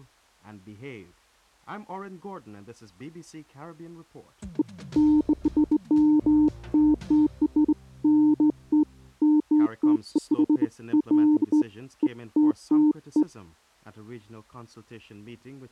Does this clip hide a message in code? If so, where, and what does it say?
No, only beeps of irregular length.